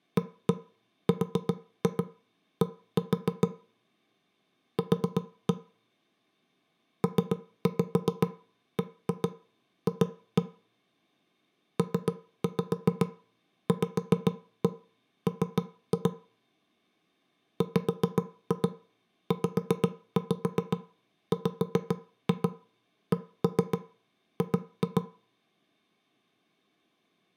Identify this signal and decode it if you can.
Tap code, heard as knocks on wood, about 7 knocks a second, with room echo. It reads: ARD Q PBF PVM WZWCG